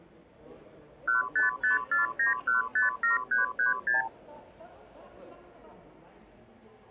Multi-frequency trunk signalling (R2, with the far end's replies), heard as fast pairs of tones, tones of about 140 ms, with the noise of a crowd indoors. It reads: 15549157336